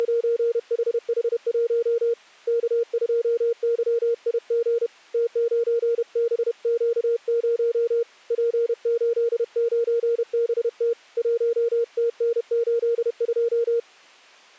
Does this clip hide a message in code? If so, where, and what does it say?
Yes: Morse code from 0.0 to 13.9 s, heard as a keyed tone, hand-sent with a paddle, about 31 wpm, 470 Hz. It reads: … K2YIG T9BQ0 P89BT 1TN82